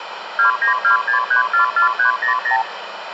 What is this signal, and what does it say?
Multi-frequency trunk signalling (R2, with the far end's replies), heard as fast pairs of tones, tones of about 120 ms, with phone line noise and room echo. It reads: 2926344300